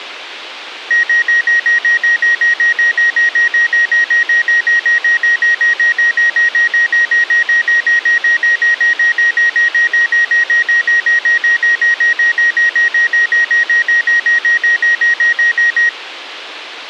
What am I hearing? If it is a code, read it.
Evenly repeated beeps. There is no code.